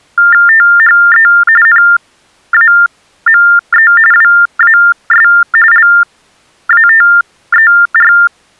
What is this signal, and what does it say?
TTY/TDD text telephone tones (45.45 baud Baudot), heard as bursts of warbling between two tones, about 400 Hz shift, 1600 Hz centre. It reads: THE NAME WAS LATER